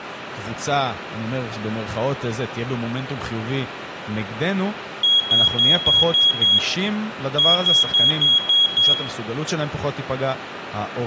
Beep code, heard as a piezo beeper, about 3300 Hz, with room echo and speech in Hebrew. 6-6.